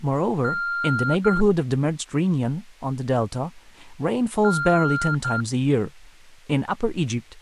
Beep code, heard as beeps, played twice, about 1390 Hz, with speech in English. 1 long, 1 short. In IBM BIOS tables: system board problem.